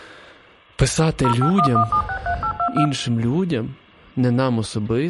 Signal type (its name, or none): DTMF